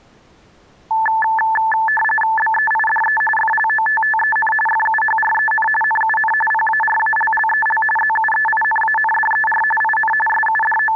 RTTY (45.45 baud, 850 Hz shift), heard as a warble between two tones, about 1310 Hz centre. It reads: BEIDE FLOTTEN FUHREN NUN PARALLEL ZUEINANDER IN …